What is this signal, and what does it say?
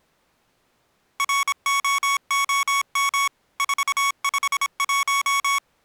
Morse code, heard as electronic beeps, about 26 wpm, 1110 Hz. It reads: ROOM 451